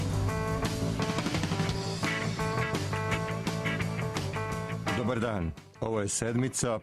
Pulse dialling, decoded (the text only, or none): none